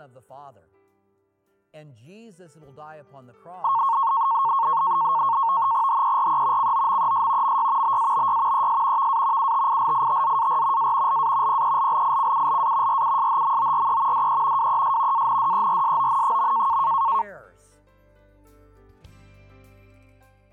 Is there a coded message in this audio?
Yes: NAVTEX (SITOR-B), 100 baud, 170 Hz shift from 3.6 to 17.2 s, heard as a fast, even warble, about 1000 Hz centre. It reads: HERE COMES MY BABY ES VA UTILITZAR A LA PELLICULA RUSHMORE DE WES ANDERSON.